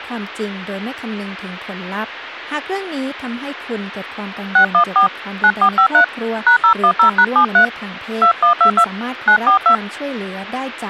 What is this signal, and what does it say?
DTMF, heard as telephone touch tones, dialled by hand, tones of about 90 ms, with speech in Thai. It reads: 614 9453 #010#73 2122 942